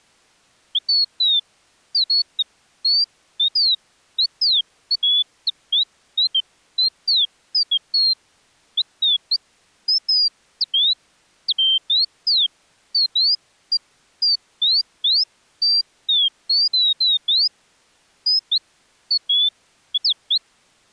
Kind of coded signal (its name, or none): none